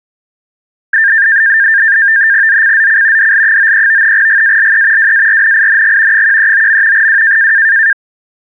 NAVTEX (SITOR-B), 100 baud, 170 Hz shift, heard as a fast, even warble, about 1700 Hz centre. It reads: ZCZC DL93 GALE WARNING 139. W